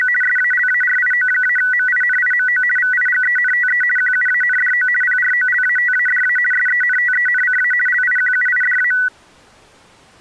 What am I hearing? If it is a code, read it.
RTTY (50 baud, 450 Hz shift), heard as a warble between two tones, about 1700 Hz centre. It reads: … SALARIO-MINIMO VIGENTE QUANDO PROLATADA SENTENCA LIQUIDA